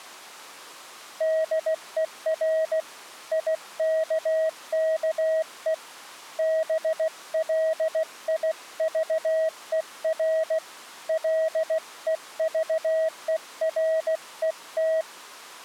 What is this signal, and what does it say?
Morse code, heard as a keyed tone, hand-sent with a paddle, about 16 wpm, 640 Hz. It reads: DER IKKE BLIVER LEVERET